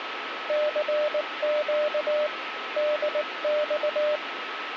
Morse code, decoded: CQ DX

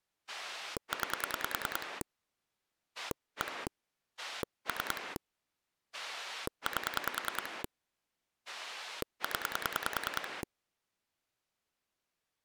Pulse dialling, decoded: 9 1 3 8 0

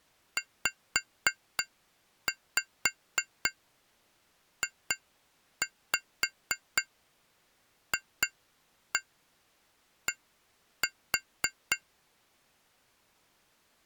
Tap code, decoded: ZJFD

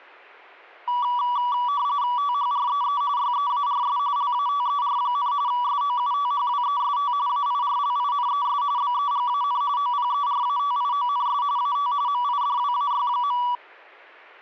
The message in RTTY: THREE YEARS LATER, SOUTHWEST AIRLINES BEGAN OPERATIONS AT MIDWAY.

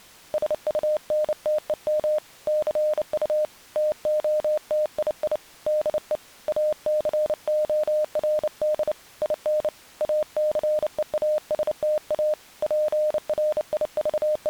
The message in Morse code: SUNTEM CU TOTII DE ACORD IN ACEASTA …

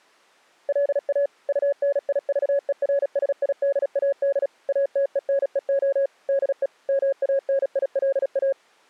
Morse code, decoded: LA UNIVERSIDAD ATENEO DE MANILA

